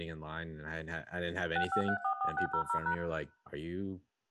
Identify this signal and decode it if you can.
DTMF, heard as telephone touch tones, dialled by machine, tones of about 90 ms, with room echo and speech in English. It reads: 65344600#